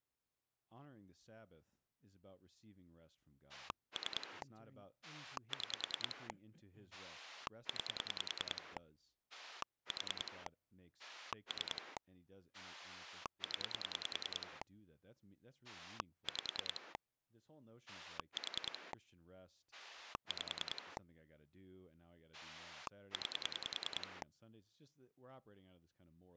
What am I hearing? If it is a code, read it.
Pulse dialling, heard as a rotary dial, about 10 pulses a second, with speech in English. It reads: 3 6 9 4 3 0 5 4 5 9